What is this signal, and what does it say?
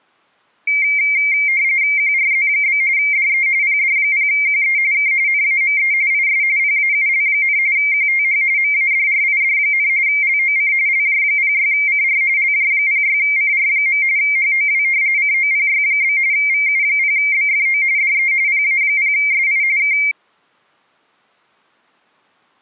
RTTY (45.45 baud, 170 Hz shift), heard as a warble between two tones, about 2200 Hz centre. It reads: QRZ? DE PD0QE K NAME IS PAUL, QTH MADRID, LOC LJ06CR LJ06CR. HOW COPY? VU0BFO DE PA0SI K